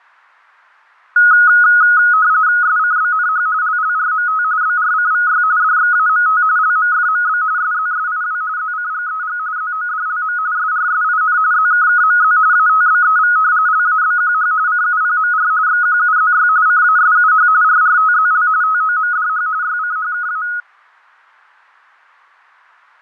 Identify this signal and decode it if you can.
RTTY (45.45 baud, 170 Hz shift), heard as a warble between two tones, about 1360 Hz centre, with fading. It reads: SCBNH LLRMT BRCVY DXAMT LMFMB SZSIW ZCGEG ZODLM SRSIN ZKKMZ ATBEV LABQH CUPMR XQUZY CASUH RRTZL TOMDH YCHKA